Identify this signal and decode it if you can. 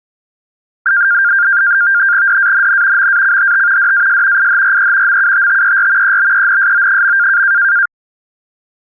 NAVTEX (SITOR-B), 100 baud, 170 Hz shift, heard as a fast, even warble, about 1500 Hz centre. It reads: DANN MACHT DAS IHRE MUTTER EBENSO.